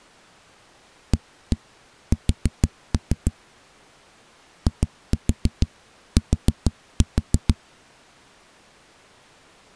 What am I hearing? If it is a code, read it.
Tap code, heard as knocks on a wall, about 6 knocks a second. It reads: AS IT